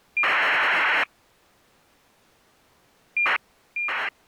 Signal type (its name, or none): ACARS aircraft data